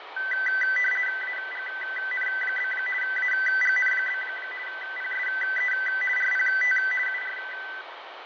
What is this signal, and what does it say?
RTTY (50 baud, 450 Hz shift), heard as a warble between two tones, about 1750 Hz centre, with radio static, fading and room echo. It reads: AGN? AGN? PSE RPT UR